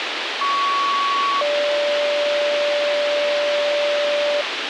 Two-tone page, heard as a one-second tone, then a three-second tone, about 1120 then 580 Hz, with radio hiss.